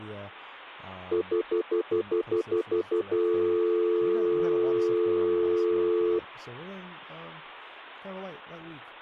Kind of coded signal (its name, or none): telephone call progress tone